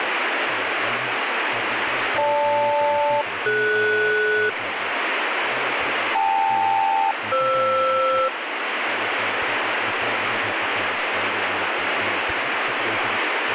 Aircraft SELCAL, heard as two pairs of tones, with radio static and speech in English. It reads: GL-DS KL-FR